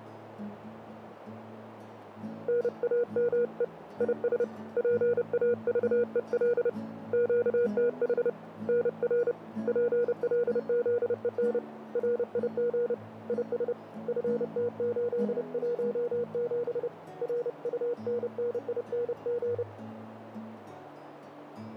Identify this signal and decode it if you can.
Morse code, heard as a keyed tone, hand-sent with a paddle, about 30 wpm, 480 Hz, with radio static and a narrow filter. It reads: NAME IS PAVEL QTH NR PLZEN RIG IS FT817 RUNNING